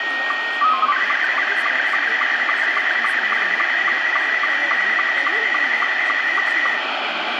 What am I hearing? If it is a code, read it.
SSTV (slow-scan television), Scottie S2, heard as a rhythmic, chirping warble, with radio static, room echo and speech in Maithili.